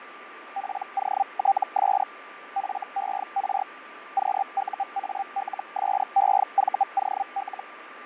Hellschreiber (Feld-Hell, 122.5 baud), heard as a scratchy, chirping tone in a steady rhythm, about 790 Hz, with radio static, fading and a steady whistle near 1180 Hz. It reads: POTS FER QUALSEVOL